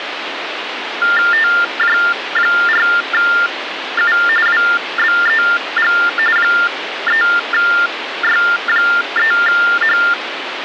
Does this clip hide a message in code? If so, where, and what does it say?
Yes: TTY/TDD text telephone tones (45.45 baud Baudot) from 1.0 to 10.1 s, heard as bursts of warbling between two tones, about 400 Hz shift, 1600 Hz centre, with phone line noise. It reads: TJ4U WBEG 3Y3H